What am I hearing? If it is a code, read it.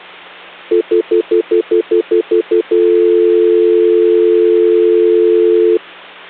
Telephone call progress tone (North American plan), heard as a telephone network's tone, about 350, 440 Hz, 0.1 s on and 0.1 s off, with hum. Stutter dial tone.